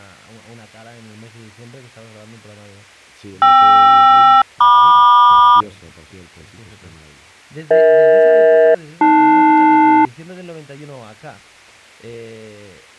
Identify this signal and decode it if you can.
Aircraft SELCAL, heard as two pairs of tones. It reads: KR-MQ EH-AL